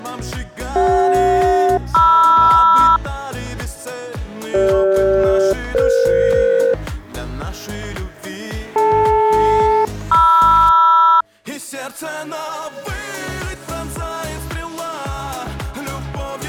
Aircraft SELCAL, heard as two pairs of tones. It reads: CJ-MR CG-EF DL-MR